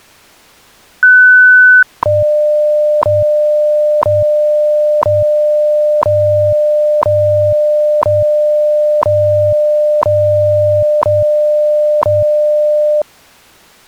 Radio time signal (WWV, Colorado), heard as ticks, one a second.